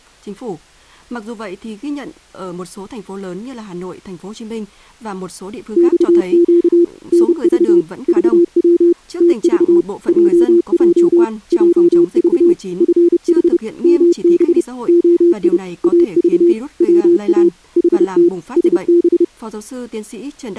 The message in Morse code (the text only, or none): XQ NV VW TV JJ JV FH MB OI AV WA HT SB